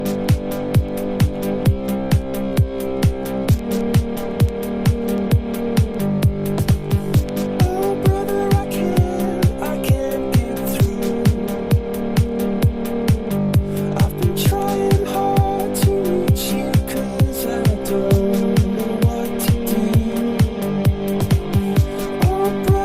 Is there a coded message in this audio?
No.